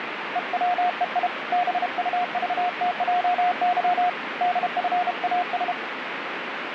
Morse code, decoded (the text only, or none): EWEI BUVTJY DFAS